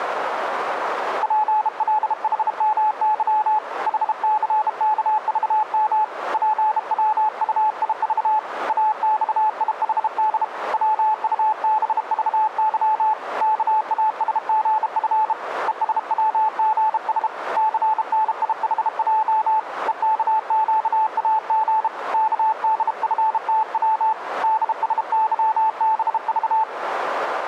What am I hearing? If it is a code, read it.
Morse code, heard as a keyed tone, hand-sent with a bug key, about 32 wpm, 870 Hz, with radio static. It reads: PLHMY HCKVM PWUIV AXIHD WUBVY KASGF ESWGS CNIHJ EKQAG KDFTW DSYBV